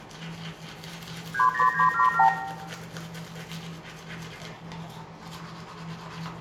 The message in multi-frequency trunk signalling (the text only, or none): 30977